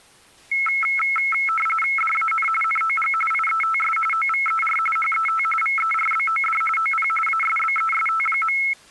RTTY (45.45 baud, 850 Hz shift), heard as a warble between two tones, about 1750 Hz centre. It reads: DAN NOG IETS OVER HET VERBOD OP ASBEST.